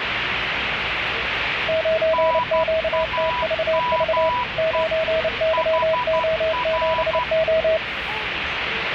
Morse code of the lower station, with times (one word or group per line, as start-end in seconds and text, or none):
1.7-4.3 9QTVV
4.6-7.8 9YO7O